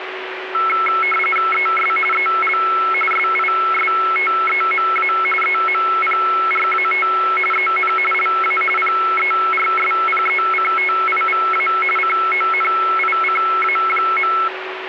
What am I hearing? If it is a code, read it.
RTTY (45.45 baud, 850 Hz shift), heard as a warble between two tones, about 1750 Hz centre, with radio static and a steady whistle near 380 Hz. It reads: ES EL SISTEMA EMPRAT EN LA PERSPECTIVA CONICA.